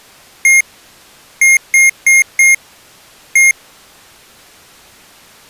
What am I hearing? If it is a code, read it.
Beep code, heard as beeps from a small speaker, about 2150 Hz. 1-4-1. In Phoenix BIOS tables: address line failure in the first 64 KB of memory.